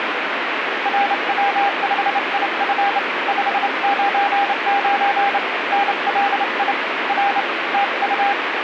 Morse code, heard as a keyed tone, hand-sent with a straight key, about 28 wpm, 800 Hz, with radio static. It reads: RW5IF 599 NLI R TU